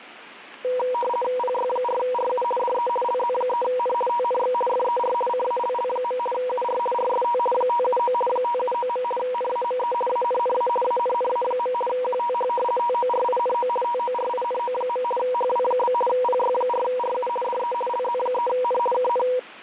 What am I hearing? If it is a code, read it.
RTTY (50 baud, 450 Hz shift), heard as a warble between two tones, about 730 Hz centre. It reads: PY4RU DE LZ3N TNX FER CALL. UR RST 579 579. NAME ANNA ANNA. QTH TORINO TORINO. HW? PY4RU DE LZ3N KN